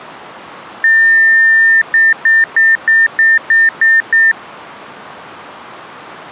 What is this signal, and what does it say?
Beep code, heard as beeps from a small speaker, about 1800 Hz. 1 long, 8 short. In AMI BIOS tables: display or retrace test failure.